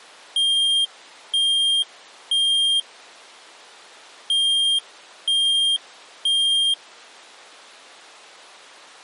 Alarm pattern, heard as an alarm's beeps, played twice, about 3200 Hz. Temporal three. Smoke or fire, evacuate.